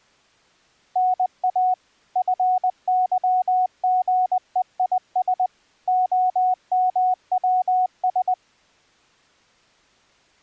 Morse code (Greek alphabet), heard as a keyed tone, machine-sent, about 20 wpm, 740 Hz. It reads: ΝΑ ΦΥΓΕΙΣ ΟΜΩΣ